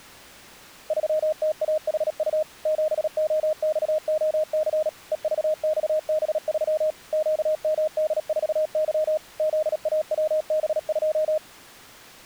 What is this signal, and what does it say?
Morse code, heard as a keyed tone, machine-sent, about 37 wpm, 620 Hz. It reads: 3TAHU 7OXOC EVXB3 QMD4Y ZAWB2